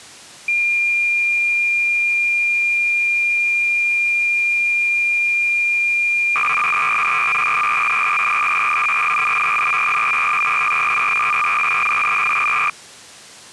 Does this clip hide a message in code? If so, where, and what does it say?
Yes: cassette data (Kansas City type), 300 baud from 0.5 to 12.7 s, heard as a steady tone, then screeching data.